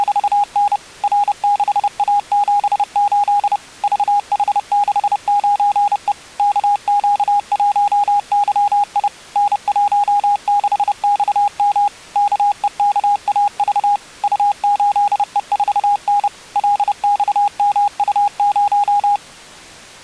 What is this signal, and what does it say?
Morse code, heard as a keyed tone, machine-sent, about 30 wpm, 820 Hz. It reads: … R6A78 VH69E KQ1YI N16XM KEKAV U8E4N LXMU0